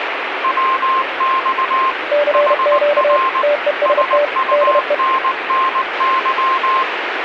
Morse code, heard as two keyed tones, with radio static. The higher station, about 19 wpm, 1060 Hz: WX HR SUNNY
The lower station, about 31 wpm, 580 Hz: CQ TEST DE